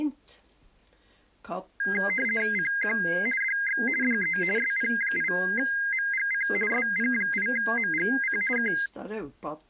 RTTY (50 baud, 450 Hz shift), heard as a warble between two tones, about 1850 Hz centre. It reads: CQ DX DE SP8MGC SP8MGC K